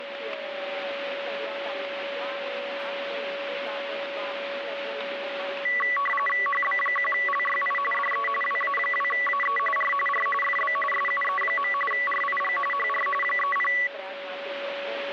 RTTY (45.45 baud, 850 Hz shift), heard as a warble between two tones, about 1550 Hz centre, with radio static and a steady whistle near 560 Hz. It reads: HB1LYI DE WA2AE R R FB SUE. RIG HR 30